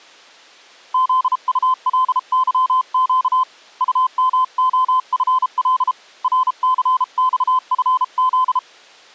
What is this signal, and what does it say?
Morse code, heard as a keyed tone, hand-sent with a paddle, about 33 wpm, 1020 Hz. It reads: ZULYQ UMOFL RCXFZ